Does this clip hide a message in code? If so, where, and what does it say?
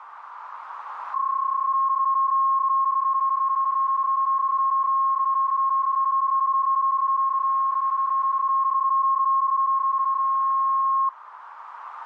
Yes: PSK31 (31.25 baud) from 1.1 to 11.1 s, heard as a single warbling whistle, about 1080 Hz, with radio static and a narrow filter.